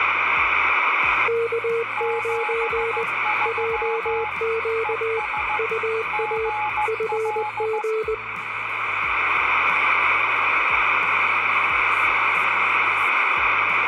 Morse code, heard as two keyed tones, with radio static. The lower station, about 20 wpm, 450 Hz: K9 JQ UA FG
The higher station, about 15 wpm, 850 Hz: 73 ES GL